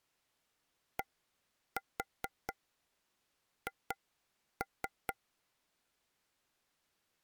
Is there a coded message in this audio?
Yes: tap code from 1.0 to 5.2 s, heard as taps on a table, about 4 knocks a second. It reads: DH